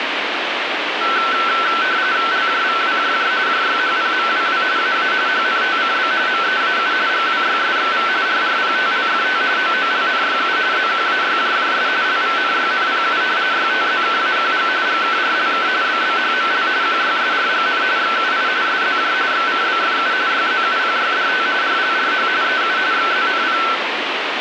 RTTY (45.45 baud, 170 Hz shift), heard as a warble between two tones, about 1430 Hz centre, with radio static. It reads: LJVWJJ JYHPMWW AA HNTCB MEAU GWYSXV RRPTLFT OOLNYU ZQAYJJS LVNYNPU YTZKAQG GKRLK BBHML QYSRGN XUI SZJ XCBFU YZUPYDT RLRH EU XZNP